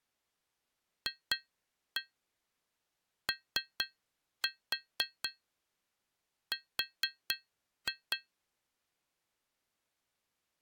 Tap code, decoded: FOR

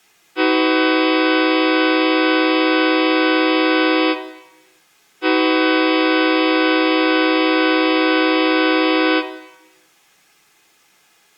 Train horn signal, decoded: 2 long

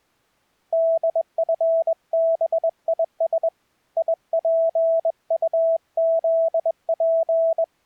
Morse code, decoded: DFBIS IPUZP

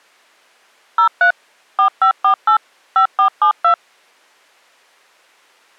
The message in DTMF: 03 4548 5472

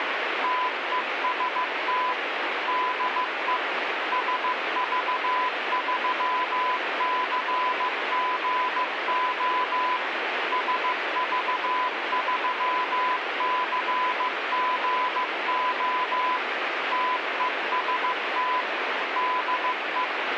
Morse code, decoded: TEST DE SV3CGO SV3CGO TEST DE

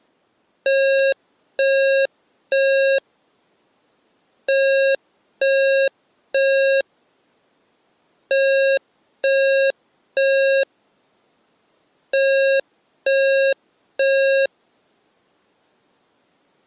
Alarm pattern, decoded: temporal three

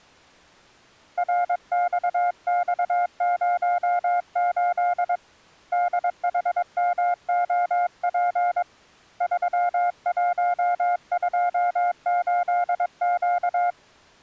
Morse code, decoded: RXX08 DHMOP 3128Q

